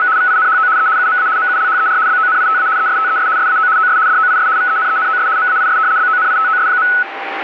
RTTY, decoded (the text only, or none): … VINHO E UMA MULHER BONITA ESTES SAO OS DOIS VENENOS MAIS BONITOS.